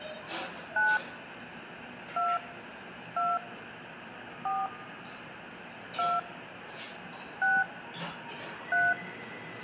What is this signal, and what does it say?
DTMF, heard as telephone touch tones, dialled by hand, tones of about 210 ms, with phone line noise, room echo and the noise of a cafe. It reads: 9 2 2 4 2 6 3